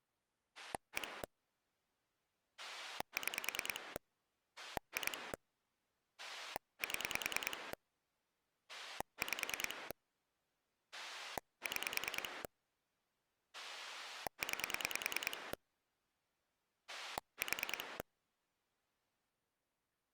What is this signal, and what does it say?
Pulse dialling, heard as a rotary dial, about 10 pulses a second. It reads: 1 6 2 7 5 6 9 4